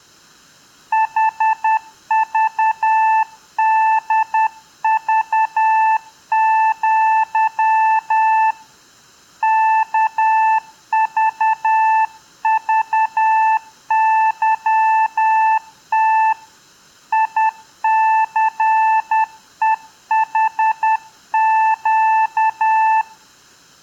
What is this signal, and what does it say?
Morse code (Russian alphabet), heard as a keyed tone, hand-sent with a paddle, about 10 wpm, 880 Hz. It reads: ХЖДЖЪ КЖЖЫТ ИЦЕХЩ